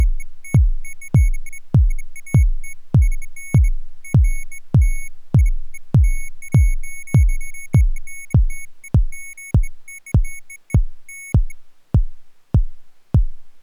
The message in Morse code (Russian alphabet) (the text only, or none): none